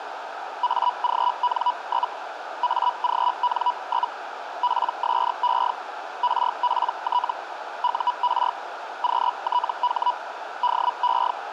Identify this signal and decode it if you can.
Hellschreiber (Feld-Hell, 122.5 baud), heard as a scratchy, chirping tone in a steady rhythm, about 980 Hz, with radio static and a narrow filter. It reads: AGN? AGN? PSE RPT UR QTH DE